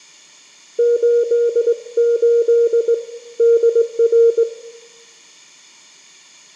Morse code, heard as a keyed tone, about 19 wpm, 470 Hz, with room echo. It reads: 88 DR